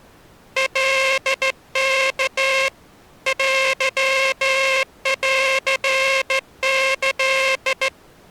Morse code (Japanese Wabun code), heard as a buzzer, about 14 wpm. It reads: カワ テンキ